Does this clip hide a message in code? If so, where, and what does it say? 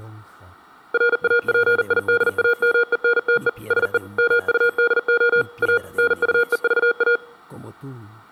Yes: Morse code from 0.9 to 7.2 s, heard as electronic beeps, machine-sent, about 40 wpm, 480 Hz. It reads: RAPIDAMENTE SE MUDO A NUEVA